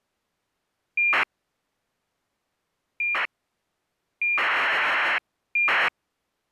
ACARS aircraft data, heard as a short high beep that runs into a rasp, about 2400 baud.